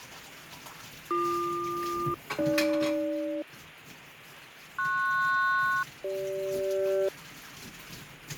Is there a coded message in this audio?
Yes: aircraft SELCAL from 1.1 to 7.1 s, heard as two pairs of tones, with radio static, fading and kitchen noise. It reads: BQ-AG PS-CG